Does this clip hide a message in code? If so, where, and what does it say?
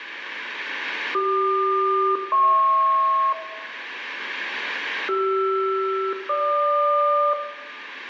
Yes: aircraft SELCAL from 1.1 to 7.3 s, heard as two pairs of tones, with room echo. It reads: CQ-HP CR-GQ